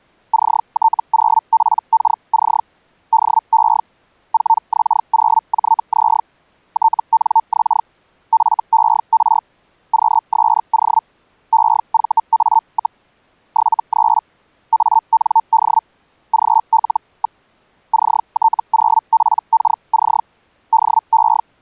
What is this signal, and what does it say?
Hellschreiber (Feld-Hell, 122.5 baud), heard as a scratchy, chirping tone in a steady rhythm, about 900 Hz. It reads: CT0PKC DE 4X0JZ TNX FER QSO EVA, 73 AND GL. CT0PKC DE